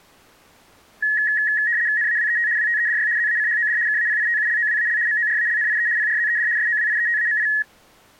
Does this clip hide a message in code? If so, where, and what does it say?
Yes: RTTY (75 baud, 170 Hz shift) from 1.0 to 7.6 s, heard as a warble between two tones, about 1800 Hz centre. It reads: NAWET WTEDY ZACHOD KAPITULOWAL MORALNIE PRZED SOWIETAMI